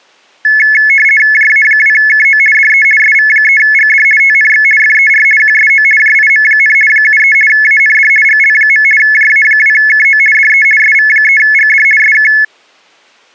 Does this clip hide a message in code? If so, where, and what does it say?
Yes: RTTY (50 baud, 450 Hz shift) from 0.4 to 12.4 s, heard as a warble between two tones, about 1950 Hz centre. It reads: JA2KO DE SV3GD TNX FER QSO JIM, 73 AND GL. JA2KO DE SV3GD SK